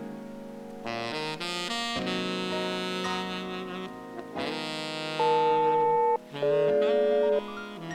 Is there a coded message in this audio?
Yes: aircraft SELCAL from 5.2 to 7.4 s, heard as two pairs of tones. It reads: EL-DG